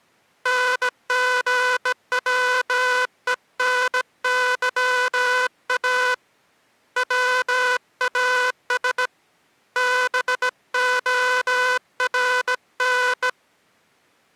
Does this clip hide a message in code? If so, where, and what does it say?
Yes: Morse code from 0.4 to 13.4 s, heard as a buzzer, hand-sent with a bug key, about 17 wpm. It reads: NGWENYA WAS BORN